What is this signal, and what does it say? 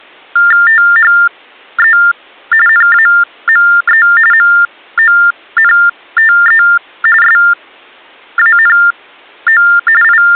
TTY/TDD text telephone tones (45.45 baud Baudot), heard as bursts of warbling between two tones, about 400 Hz shift, 1600 Hz centre. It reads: THE NAME MONTE SANO …